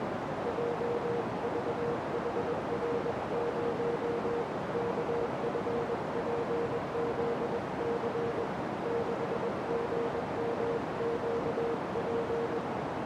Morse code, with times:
0.5-4.4 JVHR0
4.7-8.4 KFPZC
8.9-12.6 6GMQP

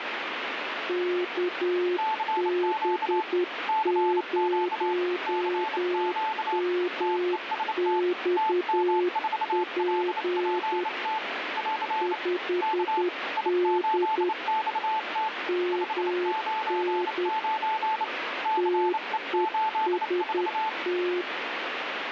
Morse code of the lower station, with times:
0.9-10.8 KB0MXP
12.0-14.3 5D
15.5-17.3 MN
18.6-21.2 TEST

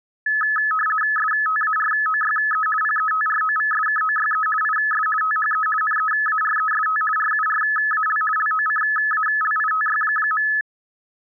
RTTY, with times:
1.2-2.7 STAROYE
2.8-4.5 PETROVSKOYE
4.6-5.1 IS
5.2-5.7 THE
5.8-7.0 NEAREST
7.2-8.2 RURAL
8.4-10.5 LOCALITY.

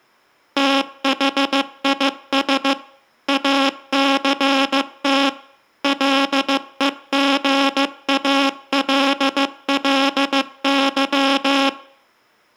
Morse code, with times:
0.6-2.7 THIS
3.3-5.3 ACT
5.8-11.7 LEGALLY

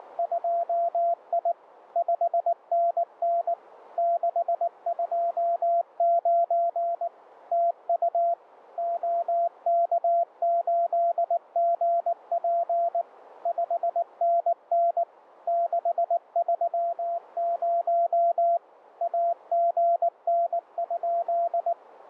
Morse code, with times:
0.0-1.5 …
2.0-3.5 5NN
4.0-7.1 629
7.5-8.3 TU
8.8-13.0 OK8GP
13.5-15.0 5NN
15.5-18.6 630
19.0-21.7 AGN?

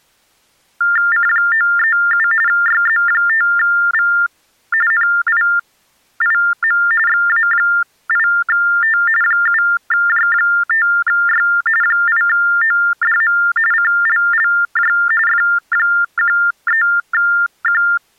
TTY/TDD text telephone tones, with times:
1.1-2.3 C937
2.5-4.1 YZ5V
4.9-6.8 NIIM
7.1-9.0 XA8T
9.2-11.5 7J5Y
11.8-13.4 8ODM
13.7-14.9 CLLJ
15.3-17.8 F13Q

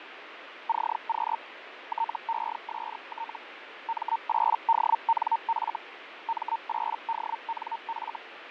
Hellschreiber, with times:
0.7-1.4 CQ
1.9-3.4 TEST
3.9-5.8 M8DNF
6.3-8.2 M8DNF

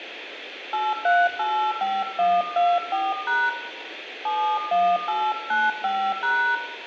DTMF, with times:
0.7-3.5 8385124#
4.2-6.6 71895#

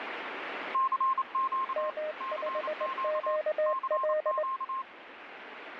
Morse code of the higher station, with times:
0.7-1.9 CQ
2.2-3.4 CQ
3.7-4.8 CQ

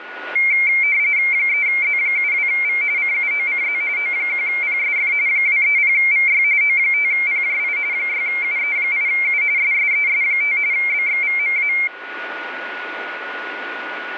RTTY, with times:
1.3-2.8 3Z72V
3.0-3.8 CUOCZ
4.0-5.1 O1PSF
5.3-6.4 230VY
6.6-7.8 O5PJI
7.9-9.4 6UE8U
9.6-10.6 SSES5
10.7-11.7 BXVMA

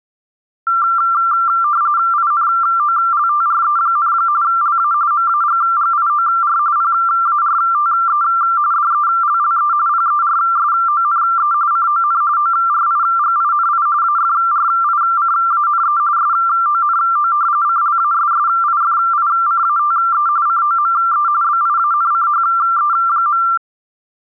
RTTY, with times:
2.1-4.1 INOLTRE,
4.4-4.9 LA
5.1-6.6 MAGGIOR
6.8-8.2 PARTE
8.7-9.7 DELLE
9.9-11.5 PERSONE
11.7-12.2 CON
12.4-13.9 ORIGINI
14.0-16.0 AFRICANE
16.2-17.3 SONO
17.6-20.3 CLASSIFICATE
20.5-21.3 COME
21.4-23.4 BIANCHE.

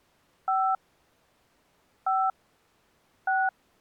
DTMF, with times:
0.5-0.8 5
2.1-2.3 5
3.3-3.5 6

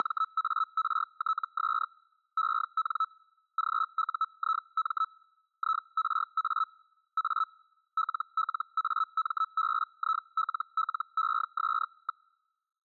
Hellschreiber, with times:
0.0-1.9 …
2.4-3.1 EN
3.6-5.1 GUIM
5.6-6.7 IRA
7.2-7.5 A
8.0-12.3 LLAMBILLES.

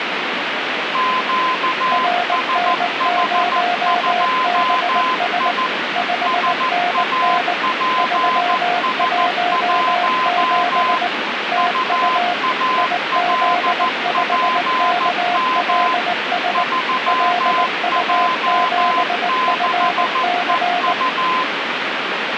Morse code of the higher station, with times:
0.9-5.7 QSH2I
6.3-11.0 SAPS1
11.6-15.9 UALPM
16.5-21.4 3J6EU

